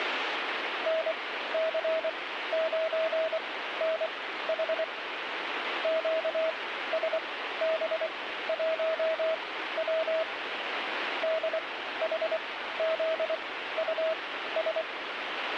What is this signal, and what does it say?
Morse code, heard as a keyed tone, machine-sent, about 24 wpm, spaced as for 14 wpm, 640 Hz, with radio static. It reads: NC9NH QSB1W DHZUS